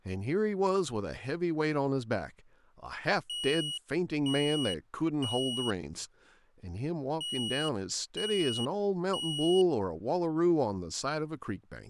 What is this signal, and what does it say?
Alarm pattern, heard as an alarm's beeps, played twice, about 2900 Hz, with speech in English. Temporal three. Smoke or fire, evacuate.